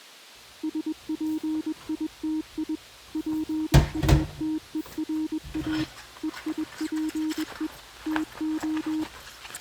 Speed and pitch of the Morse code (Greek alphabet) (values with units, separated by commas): 21 wpm, 310 Hz